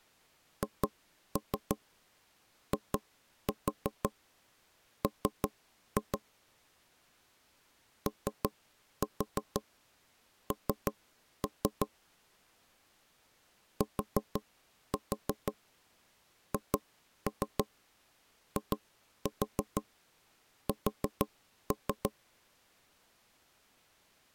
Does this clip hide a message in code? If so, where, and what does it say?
Yes: tap code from 0.6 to 22.1 s, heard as knocks on wood, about 6 knocks a second. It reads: HIM ON THIS